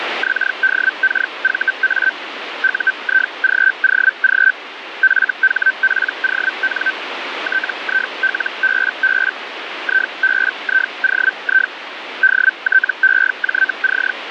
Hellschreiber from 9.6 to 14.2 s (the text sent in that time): IBIOI DTEJC